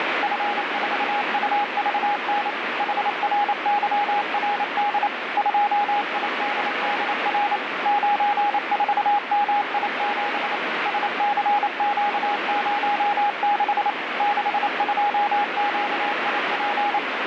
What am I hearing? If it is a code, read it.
Morse code, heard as a keyed tone, machine-sent, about 28 wpm, 820 Hz, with heavy radio static. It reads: F4UVN HRYRD 2IDDR 94MI7 SCQ06 62QIP